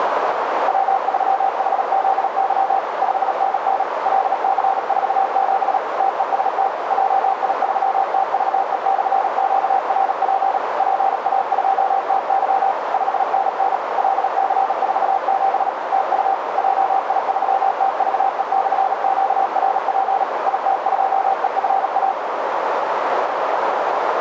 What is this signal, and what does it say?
Morse code, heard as a keyed tone, machine-sent, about 37 wpm, 780 Hz, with radio static and a narrow filter. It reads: W3HZY 5NN LC47 TEST JI3TVE/QRP PA2TY 5NN LC47 TU JI3TVE/QRP IT2EFA